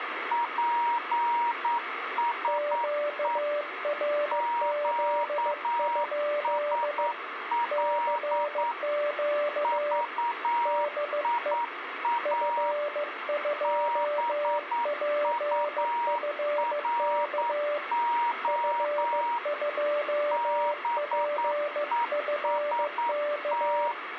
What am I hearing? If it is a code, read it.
Morse code, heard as two keyed tones, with radio static. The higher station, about 9 wpm, 950 Hz: PSE QSL VIA BURO BEST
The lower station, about 15 wpm, 590 Hz: QRZ? CQ DE F2PFK F2PFK